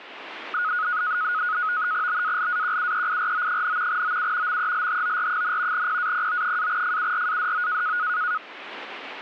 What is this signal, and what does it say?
NAVTEX (SITOR-B), 100 baud, 170 Hz shift, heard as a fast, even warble, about 1360 Hz centre. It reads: BALAQUEIRO, OU MELHOR, PAPO-FURADO